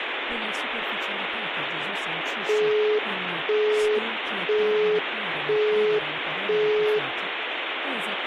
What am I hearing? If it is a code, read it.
Telephone call progress tone (single-tone plan, as in Europe, Japan and elsewhere), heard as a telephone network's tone, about 420 Hz, 0.5 s on and 0.5 s off, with phone line noise and speech in Italian. Busy tone.